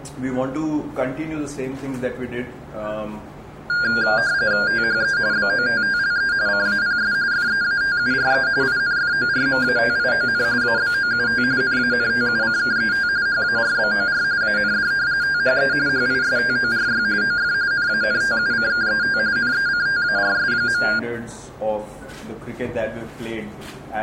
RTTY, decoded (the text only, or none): THE BOTTLE CAPS FEATURE INFORMATION ABOUT NANTUCKET HARBOR AND THE HISTORY OF NANTUCKET NECTARS.